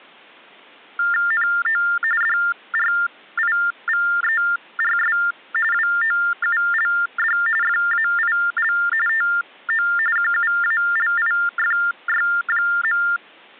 TTY/TDD text telephone tones (45.45 baud Baudot), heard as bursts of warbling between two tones, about 400 Hz shift, 1600 Hz centre. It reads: NO DRIVERS WOULD FAIL TO QUALIFY.